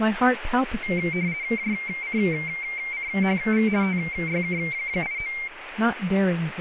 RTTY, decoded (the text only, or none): JCCHV TYK89